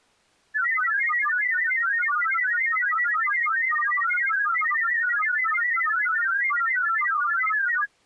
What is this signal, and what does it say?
Multi-tone FSK (Olivia or MFSK type), about 1000 Hz wide, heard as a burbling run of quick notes, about 31.25 baud.